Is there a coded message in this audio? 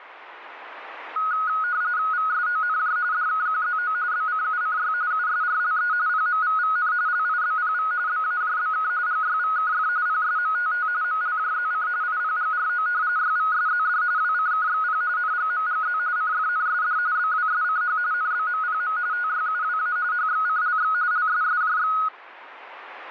Yes: RTTY (45.45 baud, 170 Hz shift) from 1.2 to 22.1 s, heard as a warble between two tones, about 1360 Hz centre, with radio static. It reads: VSONJ DKQZO BCUCY USRLE PMVVN LIBPV BAJBK GYVKF PSMTT MLJZC IPGRO YVSZD WCKXP NGMGZ CFNSD BWSCH NBMPM TYUWA HXCLX LSSJX